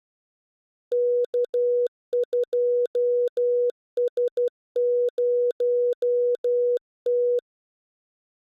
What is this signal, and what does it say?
Morse code, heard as a keyed tone, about 12 wpm, 490 Hz. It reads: K2S0T